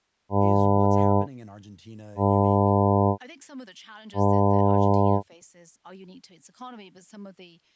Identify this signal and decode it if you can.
Ship horn signal, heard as a ship's horn, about 100 Hz, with speech in English. 3 short. At sea: I am operating astern propulsion.